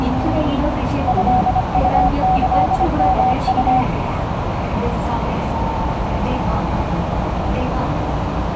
Morse code (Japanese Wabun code), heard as a keyed tone, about 25 wpm, 750 Hz, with radio static, a narrow filter and the noise inside a subway train. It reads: トウキヨウ